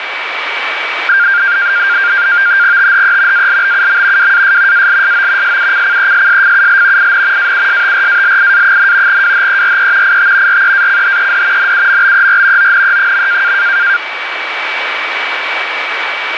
NAVTEX (SITOR-B), 100 baud, 170 Hz shift, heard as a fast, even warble, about 1500 Hz centre, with radio static and a steady whistle near 2290 Hz. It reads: THE ALBUM WAS ALSO SUCCESSFUL IN AUSTRALIA, WHERE IT REACHED NUMBER ONE.